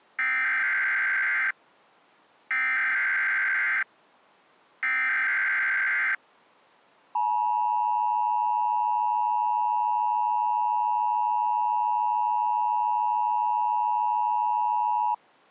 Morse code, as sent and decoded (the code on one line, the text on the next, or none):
none